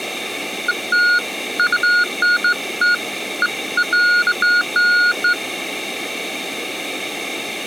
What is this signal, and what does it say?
Beeps of irregular length. There is no code.